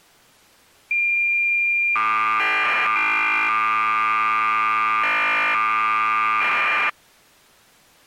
Cassette data (Kansas City type), 1200 baud, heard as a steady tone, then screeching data.